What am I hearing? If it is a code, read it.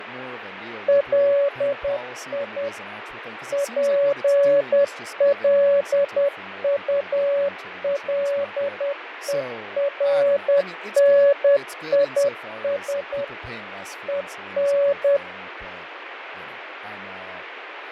Morse code, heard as a keyed tone, machine-sent, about 10 wpm, 560 Hz, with radio static, fading and speech in English. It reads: LI PLULERNIS EN